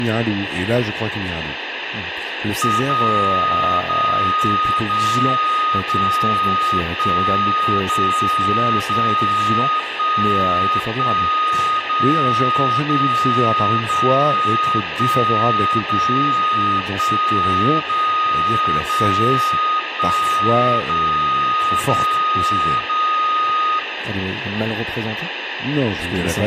Radio time signal (DCF77), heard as a tone whose level steps once a second, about 1240 Hz, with room echo and speech in French. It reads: 0 0 0 0 1 0 0 1 1 0 0 0 1 0 1 0 0 1 0 0 0